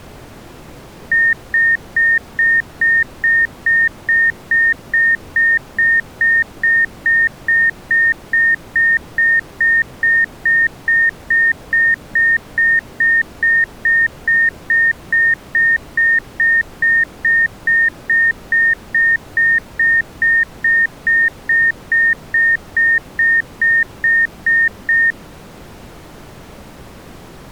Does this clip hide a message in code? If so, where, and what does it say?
No, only evenly repeated beeps.